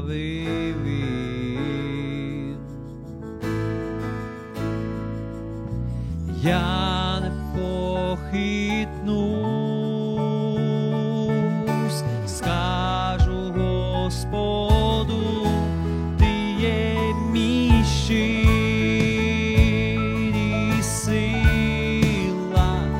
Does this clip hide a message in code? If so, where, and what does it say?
No.